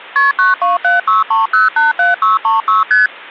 Multi-frequency trunk signalling (R1, as on North American trunks), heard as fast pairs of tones, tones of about 160 ms, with hum. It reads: KP 92763087636 ST